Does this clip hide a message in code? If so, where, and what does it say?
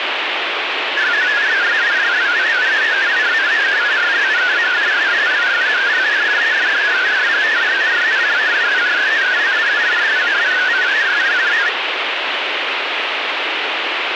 Yes: multi-tone FSK (Olivia or MFSK type), about 500 Hz wide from 1.0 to 11.7 s, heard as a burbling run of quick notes, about 62.5 baud, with radio static.